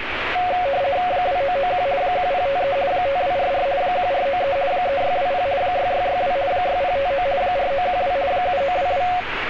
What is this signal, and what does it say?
RTTY (50 baud, 170 Hz shift), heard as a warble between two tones, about 640 Hz centre, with radio static and street noise. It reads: 2991 1053 5244 1493 3620 6662 6059 4912 7922